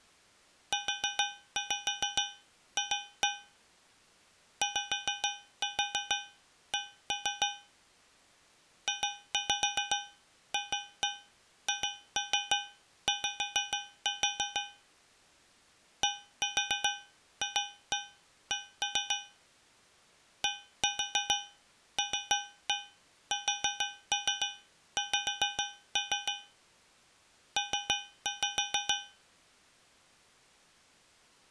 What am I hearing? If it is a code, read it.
Tap code, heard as taps on a metal pipe, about 6 knocks a second. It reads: UF YC JFHY DFC DLSX P